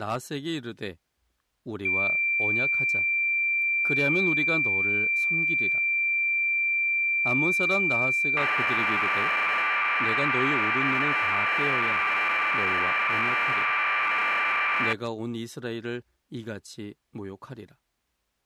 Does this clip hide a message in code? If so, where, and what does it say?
Yes: cassette data (Kansas City type), 1200 baud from 1.9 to 14.9 s, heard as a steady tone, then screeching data, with speech in Korean.